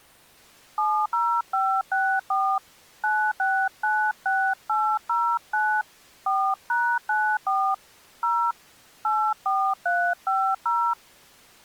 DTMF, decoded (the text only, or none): 70564 9696809 4#94 0 84350